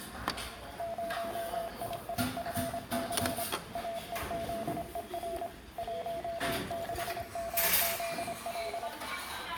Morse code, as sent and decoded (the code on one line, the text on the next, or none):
----- .. .. ..-. -.-. / .- . --.. . .-. / .---- -.... -- --.. .-..
0IIFC AEZER 16MZL